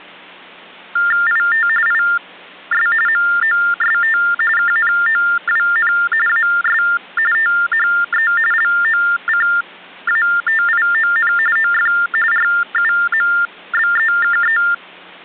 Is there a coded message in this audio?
Yes: TTY/TDD text telephone tones (45.45 baud Baudot) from 1.0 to 14.7 s, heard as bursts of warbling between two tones, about 400 Hz shift, 1600 Hz centre. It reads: IT IS MOST KNOWN AS THE LOCATION OF RUMBEKE